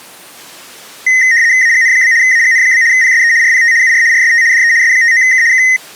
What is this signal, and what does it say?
RTTY (75 baud, 170 Hz shift), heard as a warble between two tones, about 1950 Hz centre. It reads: AGN? AGN? PSE RPT UR RST DE S59K K